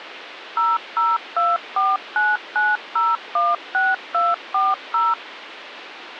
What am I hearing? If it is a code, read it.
DTMF, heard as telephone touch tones, dialled by machine, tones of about 200 ms, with phone line noise. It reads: 002499016240